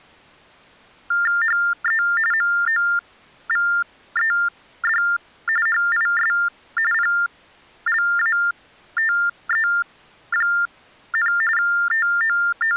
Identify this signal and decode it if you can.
TTY/TDD text telephone tones (45.45 baud Baudot), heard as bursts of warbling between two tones, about 400 Hz shift, 1600 Hz centre. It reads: HE MOVED HIS PLATE, …